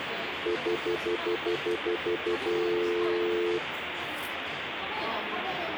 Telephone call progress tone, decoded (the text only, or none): stutter dial tone